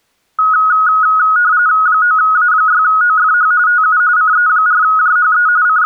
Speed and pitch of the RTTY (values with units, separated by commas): 45.45 baud, 170 Hz shift, 1360 Hz centre